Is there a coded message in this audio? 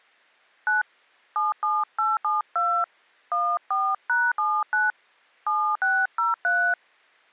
Yes: DTMF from 0.7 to 6.7 s, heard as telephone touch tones, dialled by hand, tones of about 230 ms. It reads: 9 77872 14#79 7603